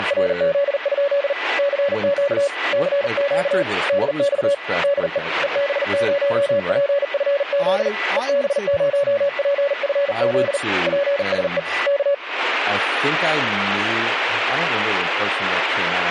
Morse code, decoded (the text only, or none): … CQ CQ DX DE EB0PFZ EB0PFZ PSE K